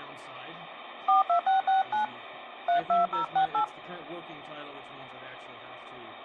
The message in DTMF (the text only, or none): 42669 32068